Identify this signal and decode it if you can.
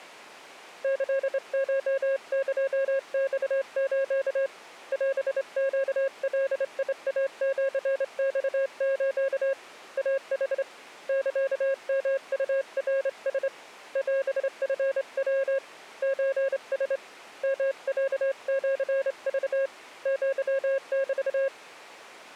Morse code (Japanese Wabun code), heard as a keyed tone, hand-sent with a straight key, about 27 wpm, 540 Hz. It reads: キコエマス オネガイシマス イヌ サヨウナラ オチヤ ソラ ヨロシク アメ